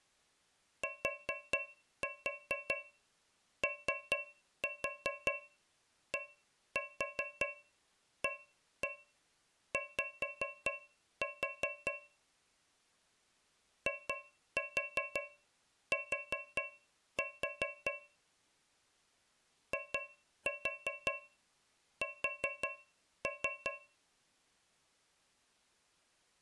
Tap code, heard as taps on a metal pipe, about 5 knocks a second. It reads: TODAY IT IS